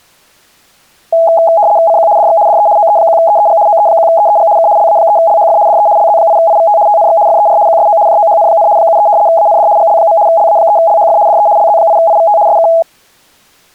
RTTY (75 baud, 170 Hz shift), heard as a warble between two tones, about 750 Hz centre. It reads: CQ DX DE OE1EEG OE1EEG K LA3LHF DE LZ8IVT TNX FER QSO JOHN, 73 AND GL. LA3LHF DE LZ8IVT SK